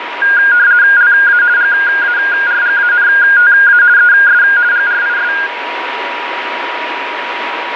RTTY (50 baud, 170 Hz shift), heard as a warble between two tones, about 1550 Hz centre, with radio static and a steady whistle near 960 Hz. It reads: LA GARGANTA ES GRIS